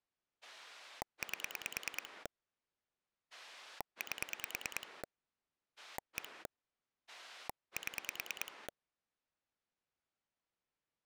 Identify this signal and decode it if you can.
Pulse dialling, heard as a rotary dial, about 9 pulses a second. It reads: 8 8 1 7